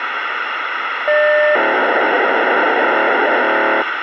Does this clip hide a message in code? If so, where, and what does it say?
Yes: POCSAG pager data (1200 baud) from 1.1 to 3.8 s, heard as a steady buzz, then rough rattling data, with radio hiss.